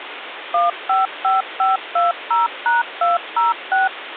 DTMF, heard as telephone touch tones, dialled by machine, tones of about 160 ms, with phone line noise. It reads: 155520#206